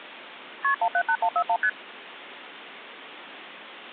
Multi-frequency trunk signalling (R1, as on North American trunks), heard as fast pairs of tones, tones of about 70 ms. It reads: KP 178141 ST